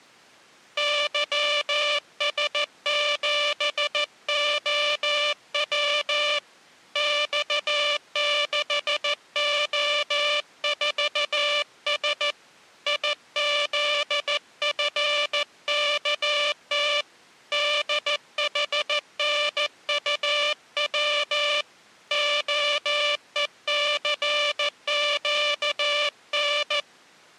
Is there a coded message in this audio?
Yes: Morse code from 0.7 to 26.9 s, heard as a buzzer, hand-sent with a paddle, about 14 wpm. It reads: YS7OW X6O4S IZFKT DHNUW OECQN